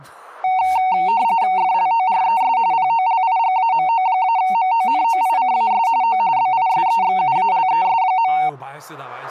RTTY (45.45 baud, 170 Hz shift), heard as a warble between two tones, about 830 Hz centre, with speech in Korean. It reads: FLORES POLIGAMO-MONOICAS O BISEXUALES.